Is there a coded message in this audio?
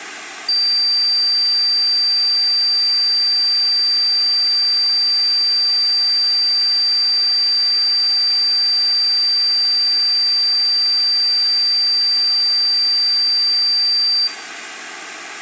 No, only a steady tone, with room echo.